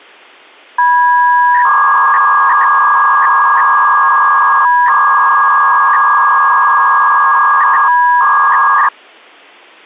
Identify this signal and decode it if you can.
300-baud modem data (V.21 tones), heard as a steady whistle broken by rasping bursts, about 300 baud, 200 Hz shift.